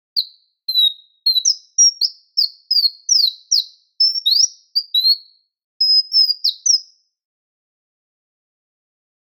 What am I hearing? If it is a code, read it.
Bird-like chirps. There is no code.